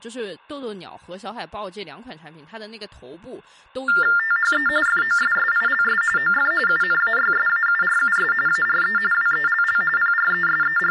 TTY/TDD text telephone tones (45.45 baud Baudot), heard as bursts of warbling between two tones, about 400 Hz shift, 1600 Hz centre, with room echo and speech in Chinese. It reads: THE FOSSILS OF UNAYSAURUS ARE WELL …